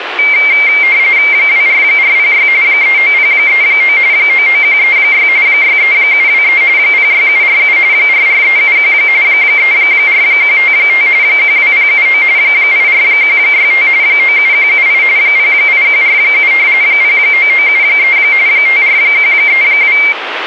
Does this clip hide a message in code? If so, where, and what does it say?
Yes: RTTY (45.45 baud, 170 Hz shift) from 0.2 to 20.1 s, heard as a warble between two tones, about 2200 Hz centre, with radio static. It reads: 24406 39039 99136 63723 06747 44371 34155 12079 84165 97178 08147 09973 54132